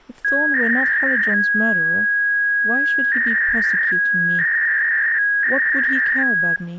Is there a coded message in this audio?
Yes: 300-baud modem data (V.21 tones) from 0.2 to 6.6 s, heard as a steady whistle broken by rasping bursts, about 300 baud, 200 Hz shift, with speech in English.